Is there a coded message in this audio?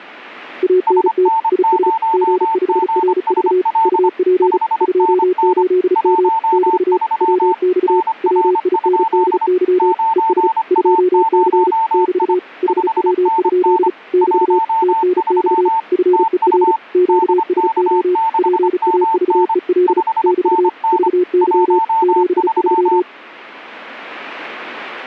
Yes: Morse code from 0.6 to 23.1 s, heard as two keyed tones. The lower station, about 35 wpm, 360 Hz: ANT IS G5RV UP 28M <BT> WX WINDY ES 2C <BT> HW? <BT> TNX FER QSO PAVEL <BT> VY 73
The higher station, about 25 wpm, 900 Hz: SN0GSL 5NN 13 NR? 9A0I 5NN 13 TU DK6MN 5NN 13